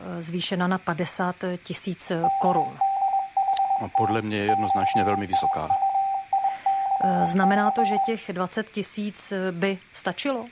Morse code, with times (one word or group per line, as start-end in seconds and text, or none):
2.2-4.1 DDHT
4.5-8.0 XIUICC